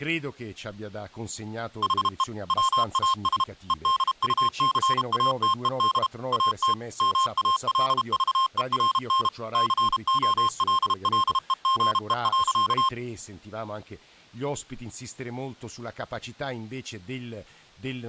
Morse code, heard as electronic beeps, machine-sent, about 32 wpm, 1060 Hz, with speech in Italian. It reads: HE WAS EDUCATED AT MALVERN COLLEGE.